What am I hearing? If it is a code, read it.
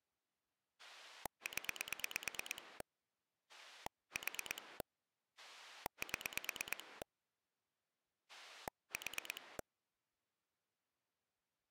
Pulse dialling, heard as a rotary dial, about 9 pulses a second. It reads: 0 4 7 4